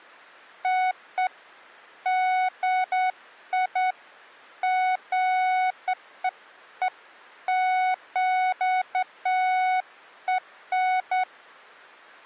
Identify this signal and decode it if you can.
Beeps of irregular length. There is no code.